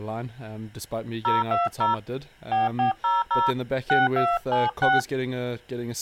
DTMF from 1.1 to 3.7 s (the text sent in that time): 020 4400